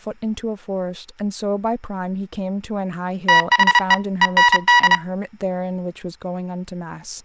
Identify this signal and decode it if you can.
Morse code, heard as electronic beeps, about 31 wpm, 970 Hz, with speech in English. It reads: THE END